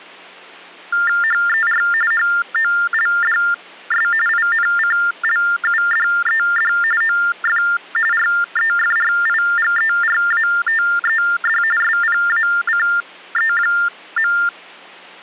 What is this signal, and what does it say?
TTY/TDD text telephone tones (45.45 baud Baudot), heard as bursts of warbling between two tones, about 400 Hz shift, 1600 Hz centre. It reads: HER HOLDS INCLUDED OF REFRIGERATED SPACE.